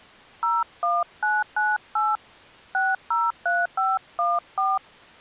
DTMF, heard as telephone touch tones, dialled by hand, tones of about 200 ms. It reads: 01998 603514